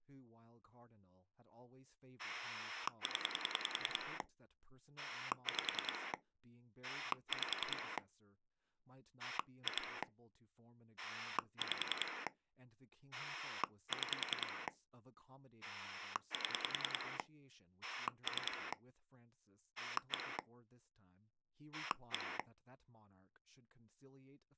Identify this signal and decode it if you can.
Pulse dialling, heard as a rotary dial, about 10 pulses a second, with speech in English. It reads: 0 5 5 2 5 6 7 3 1 1